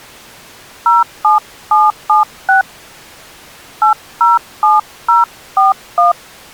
DTMF, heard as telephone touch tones, dialled by hand, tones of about 150 ms. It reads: 07776 807041